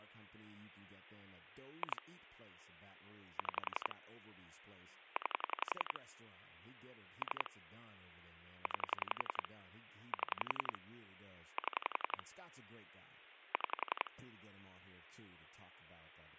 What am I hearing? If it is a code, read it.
Pulse dialling, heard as clicks on a phone line, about 11 pulses a second, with speech in English. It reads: 2 6 9 3 9 7 7 6